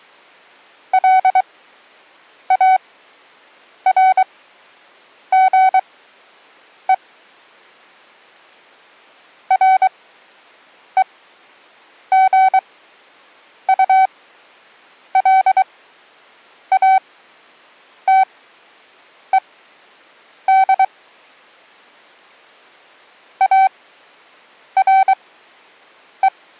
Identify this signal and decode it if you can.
Morse code, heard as a keyed tone, machine-sent, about 23 wpm, spaced as for 7 wpm, 760 Hz. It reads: LARGE REGULATED ARE